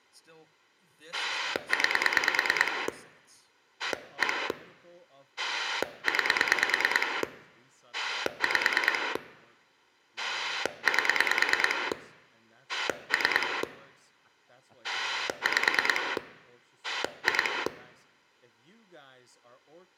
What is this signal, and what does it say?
Pulse dialling, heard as a rotary dial, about 9 pulses a second, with room echo and speech in English. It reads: 9 1 9 5 8 3 5 2